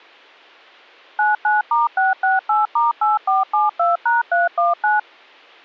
DTMF, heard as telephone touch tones, dialled by machine, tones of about 160 ms. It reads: 99*668*8472#319